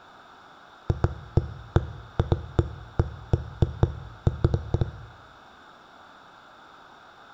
Irregular knocks on a wall. There is no code.